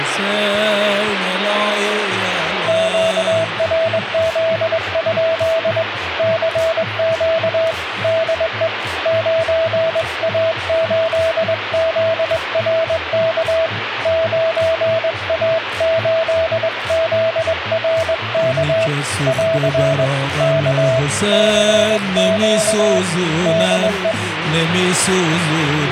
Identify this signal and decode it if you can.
Morse code, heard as a keyed tone, hand-sent with a straight key, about 21 wpm, 650 Hz, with radio static. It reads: QRZ? CQ DE 9A8ZRK 9A8ZRK <AR> K CQ DE